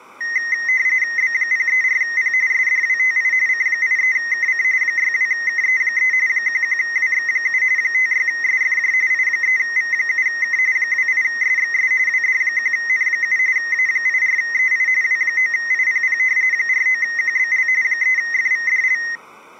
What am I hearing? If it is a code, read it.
RTTY (45.45 baud, 170 Hz shift), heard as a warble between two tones, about 1950 Hz centre. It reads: B034P SDWTI C83KC 62KE3 11WX7 56SFJ I3V7K 28SXS WD1N7 A84EI W9IPP 49QBL 3FVDL